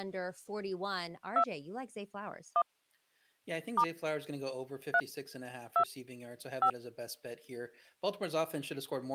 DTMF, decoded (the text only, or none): 2 1 * 3 2 5